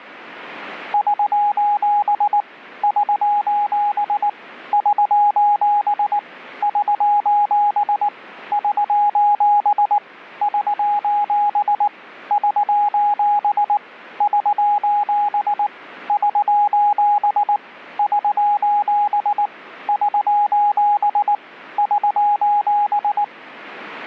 Morse code, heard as a keyed tone, machine-sent, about 19 wpm, 830 Hz. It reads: <SOS> <SOS> <SOS> <SOS> <SOS> <SOS> <SOS> <SOS> <SOS> <SOS> <SOS> <SOS>